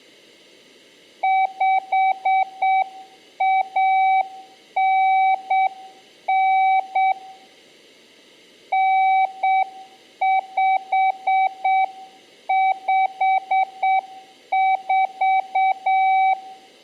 Morse code (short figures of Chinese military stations), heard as a keyed tone, hand-sent with a straight key, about 7 wpm, 760 Hz, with room echo. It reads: 5199 9554